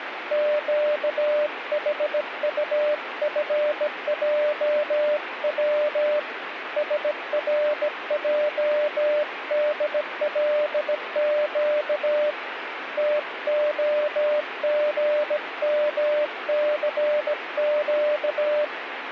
Morse code, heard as a keyed tone, hand-sent with a bug key, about 17 wpm, 600 Hz, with radio static. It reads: QHUFJW SRJDLQ TOGMCQ